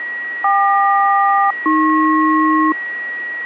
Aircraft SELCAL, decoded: KQ-AP

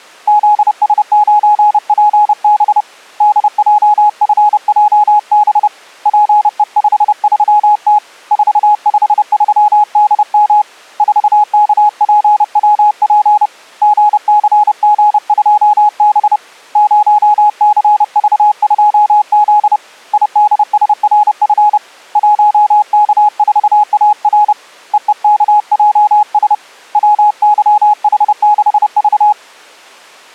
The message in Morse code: ZS9PB DJFJB PE53T 453DM 4KPWP GCG2B 0CV2Z IDSRF 1K4AR EEKJS WYH6V

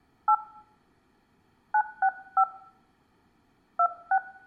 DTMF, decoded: 8 965 26

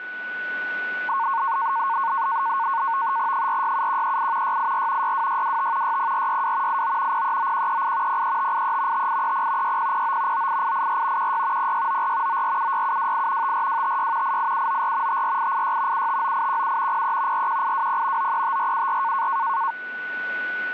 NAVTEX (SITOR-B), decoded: 467138 684 62625 60462 89 039138 03583 5830 6009 98884 16 0694 9476728 54256 88794 54886 759817 03 41820 935474

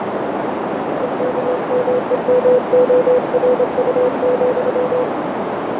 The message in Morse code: EKMEMORU,

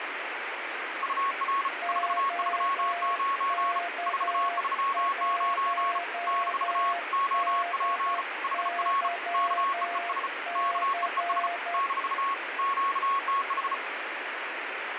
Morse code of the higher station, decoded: UR 439 439 - OP HR KEES KEES - QTH

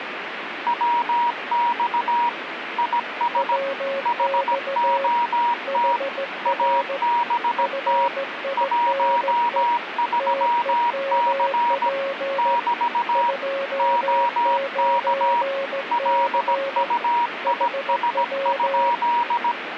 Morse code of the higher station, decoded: WX IS HOT ABT 13C <BT> OK LUIS?

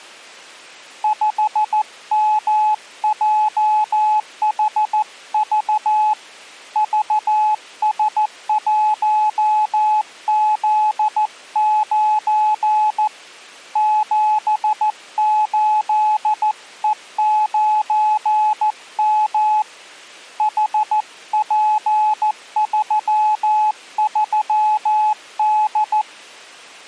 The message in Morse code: 5MJHV VS1Z9 78E9M HP33D

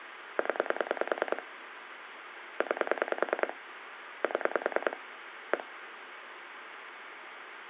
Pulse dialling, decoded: 0 9 7 1

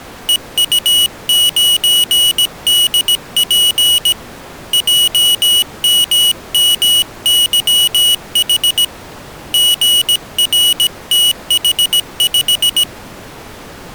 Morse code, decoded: EU9DP JMMYH GRTH5

